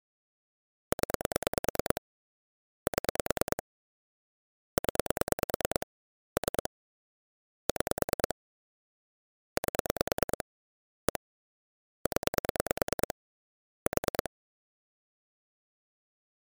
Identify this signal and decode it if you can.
Pulse dialling, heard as clicks on a phone line, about 9 pulses a second. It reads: 0 7 0 3 6 8 1 0 4